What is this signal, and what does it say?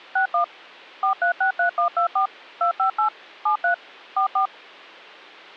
DTMF, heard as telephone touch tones, dialled by machine, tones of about 100 ms. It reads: 61 4363124 258 73 44